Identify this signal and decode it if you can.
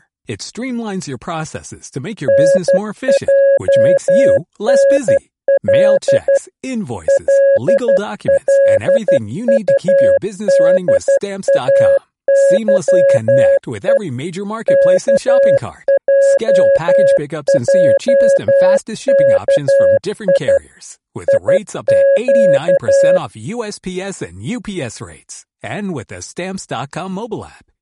Morse code, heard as a keyed tone, machine-sent, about 12 wpm, 550 Hz, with speech in German. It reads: NJNL LLUDAYE KJJKI IQ